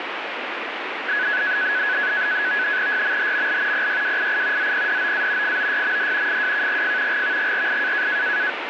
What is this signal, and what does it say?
NAVTEX (SITOR-B), 100 baud, 170 Hz shift, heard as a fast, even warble, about 1600 Hz centre, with radio static. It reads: YMHML PYWII ZPDOA FOYMD FWKGF GVGRI